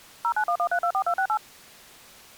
DTMF, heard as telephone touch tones, dialled by machine, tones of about 80 ms. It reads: 0911324268